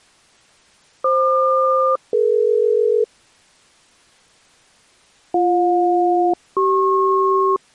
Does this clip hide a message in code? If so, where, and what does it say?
Yes: aircraft SELCAL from 1.0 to 7.6 s, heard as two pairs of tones. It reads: FQ-DE BJ-CP